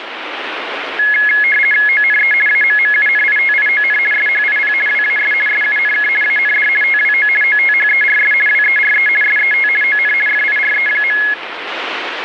RTTY (50 baud, 450 Hz shift), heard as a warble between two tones, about 1900 Hz centre, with radio static. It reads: ONE AMMUNITION SHIP WAS SUNK AND TWO OTHERS WERE SET ON FIRE.